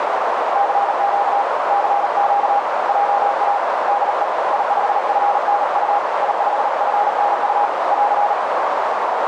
Morse code, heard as a keyed tone, hand-sent with a paddle, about 38 wpm, 810 Hz, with heavy radio static and a narrow filter. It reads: CQ CQ JA DE I5FNU I5FNU <AR>